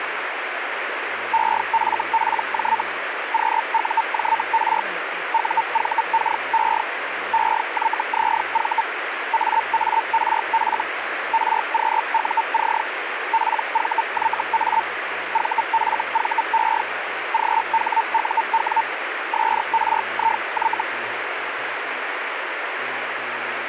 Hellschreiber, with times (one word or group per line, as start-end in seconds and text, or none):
1.3-2.8 EFPJ
3.3-4.8 QUJR
5.3-6.8 UVKE
7.3-8.8 EYZV
9.3-10.8 AARF
11.3-12.8 RQUC
13.3-14.8 PVYA
15.3-16.8 VFVE
17.3-18.8 GHUW
19.3-20.8 SRIY